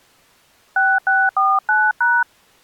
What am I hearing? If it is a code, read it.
DTMF, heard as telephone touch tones, dialled by hand, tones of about 220 ms. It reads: 6649#